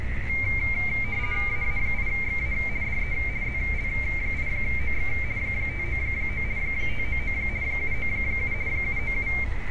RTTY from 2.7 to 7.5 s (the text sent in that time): DE ZL8OX 599 599